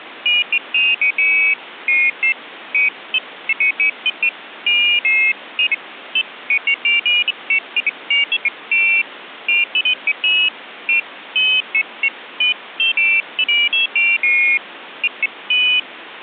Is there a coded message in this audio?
No, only pairs of high tones at irregular times, with phone line noise.